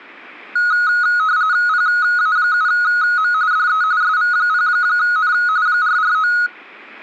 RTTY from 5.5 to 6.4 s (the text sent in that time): 449